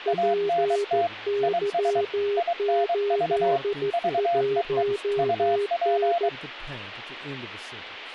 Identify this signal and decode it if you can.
Morse code, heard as two keyed tones, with speech in English. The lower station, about 14 wpm, 410 Hz: PY81N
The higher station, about 23 wpm, 690 Hz: ANT IS INV VEE UP